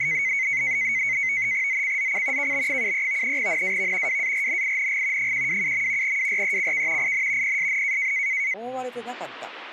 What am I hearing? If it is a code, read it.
NAVTEX (SITOR-B), 100 baud, 170 Hz shift, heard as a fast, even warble, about 2150 Hz centre, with speech in Japanese. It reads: ZCZC KB73 NAV WARNING 127. WRECK IN PSN